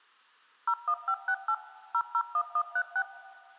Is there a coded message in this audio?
Yes: DTMF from 0.7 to 3.0 s, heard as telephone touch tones, dialled by machine, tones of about 70 ms. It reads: 01568 001136